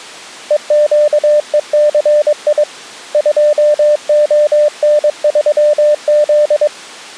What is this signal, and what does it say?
Morse code, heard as a keyed tone, hand-sent with a paddle, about 22 wpm, 600 Hz. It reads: EQECI 2ON3Z